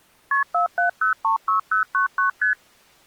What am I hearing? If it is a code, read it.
Multi-frequency trunk signalling (R1, as on North American trunks), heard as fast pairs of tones, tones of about 120 ms. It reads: KP 47036099 ST